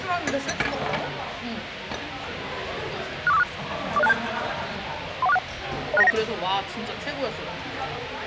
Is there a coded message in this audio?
Yes: five-tone selective call (EIA) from 3.3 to 6.1 s, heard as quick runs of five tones, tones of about 30 ms, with radio hiss and the noise of a crowd indoors. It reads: 64546 40627 31461 06919